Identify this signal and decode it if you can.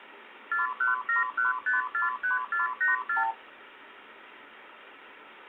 Multi-frequency trunk signalling (R2, with the far end's replies), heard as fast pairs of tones, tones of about 140 ms, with phone line noise. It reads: 4171543484